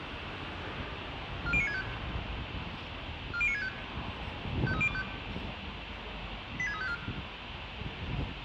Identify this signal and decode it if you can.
Five-tone selective call (ZVEI), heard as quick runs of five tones, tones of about 70 ms, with radio hiss, room echo and the noise of a residential street. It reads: 40965 40965 53025 86354